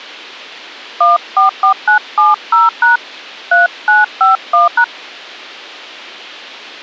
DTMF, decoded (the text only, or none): 144970# 3951#